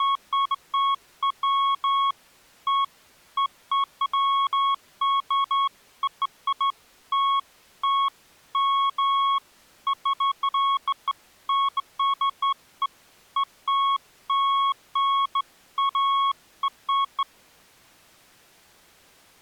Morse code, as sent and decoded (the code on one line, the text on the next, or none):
none